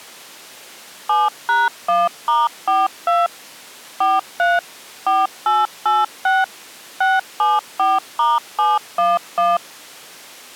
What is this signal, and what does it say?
DTMF, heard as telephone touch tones, dialled by machine, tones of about 190 ms. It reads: 7#1*42 43 4886 674*711